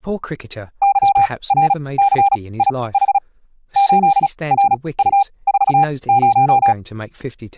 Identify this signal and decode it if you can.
Morse code, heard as a keyed tone, machine-sent, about 36 wpm, spaced as for 23 wpm, 800 Hz, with speech in English. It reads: YRCIH 8RU40